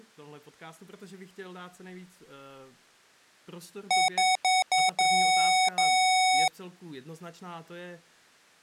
Beep code, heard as beeps from a small speaker, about 750 Hz, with speech in Slovak. 4 short, 2 long.